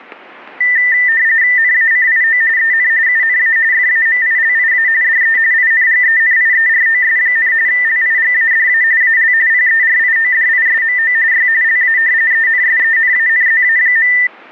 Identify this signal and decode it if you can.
RTTY (45.45 baud, 170 Hz shift), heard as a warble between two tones, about 1900 Hz centre, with static crashes. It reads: NACIO EN UNA FAMILIA DE INGENIEROS, LIGADA AL PERIODISMO Y LA ENSENANZA.